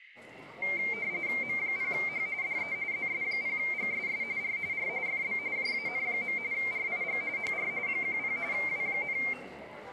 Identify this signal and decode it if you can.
RTTY (45.45 baud, 170 Hz shift), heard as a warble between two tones, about 2200 Hz centre, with radio static, room echo and the noise of a crowd indoors. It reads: M0H DE ZS0GSS R R FB JAN. RIG HR 10 W,